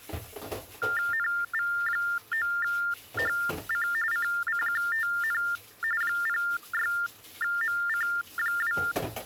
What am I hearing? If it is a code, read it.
TTY/TDD text telephone tones (45.45 baud Baudot), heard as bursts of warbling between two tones, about 400 Hz shift, 1600 Hz centre, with kitchen noise. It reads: NV9HC CCQTN 06MC2